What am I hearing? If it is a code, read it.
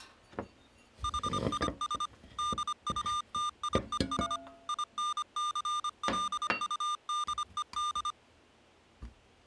Morse code, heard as electronic beeps, machine-sent, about 25 wpm, 1200 Hz, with kitchen noise. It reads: HIS DUTIES INCLUDED